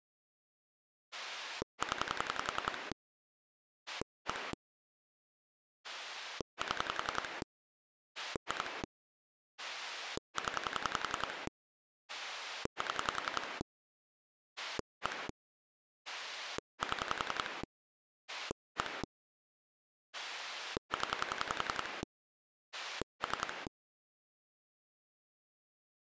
Pulse dialling, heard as a rotary dial, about 10 pulses a second. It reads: 0 1 7 2 0 7 1 7 1 0 3